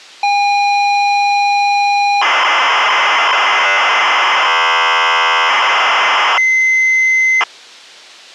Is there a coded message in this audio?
Yes: ZX Spectrum tape loading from 0.2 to 7.4 s, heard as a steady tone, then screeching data.